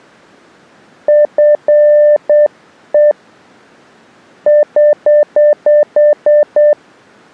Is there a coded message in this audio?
Yes: Morse code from 1.0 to 6.8 s, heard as a keyed tone, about 8 wpm, 600 Hz. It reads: FE <HH>